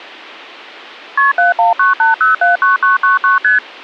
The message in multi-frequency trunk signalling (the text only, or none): KP 7198079999 ST